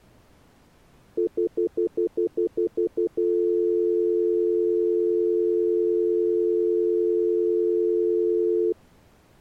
Telephone call progress tone (North American plan), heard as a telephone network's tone, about 350, 440 Hz, 0.1 s on and 0.1 s off. Stutter dial tone.